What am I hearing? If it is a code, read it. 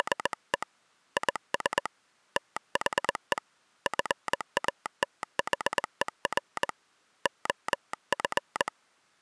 Morse code, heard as a telegraph sounder, hand-sent with a straight key, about 20 wpm. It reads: … IS THE FATHER OF